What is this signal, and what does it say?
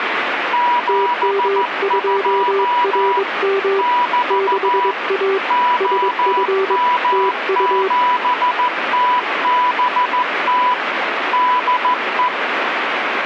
Morse code, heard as two keyed tones, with radio static. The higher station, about 14 wpm, 980 Hz: 72 <BT> OM7TBT DE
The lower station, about 22 wpm, 390 Hz: TM2RM 6A SF TU